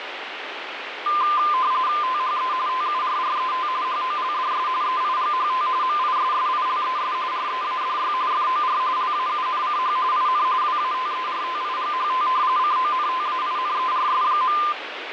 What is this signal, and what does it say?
RTTY (45.45 baud, 170 Hz shift), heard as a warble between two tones, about 1110 Hz centre, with radio static. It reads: THE TURRET HOLDS EIGHT MISSILES READY FOR LAUNCH IN WATERTIGHT CONTAINERS.